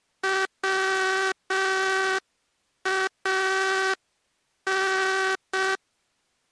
Morse code (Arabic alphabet), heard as a buzzer, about 6 wpm. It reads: وان